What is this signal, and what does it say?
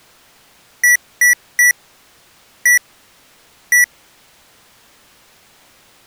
Beep code, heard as beeps from a small speaker, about 1950 Hz. 3-1-1. In Phoenix BIOS tables: DMA register failure.